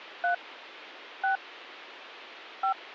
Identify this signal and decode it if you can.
DTMF, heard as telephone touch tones, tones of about 100 ms, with phone line noise. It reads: 3 6 5